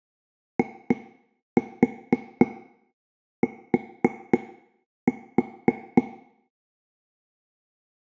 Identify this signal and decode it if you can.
Tap code, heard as taps on a table, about 4 knocks a second, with room echo. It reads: IT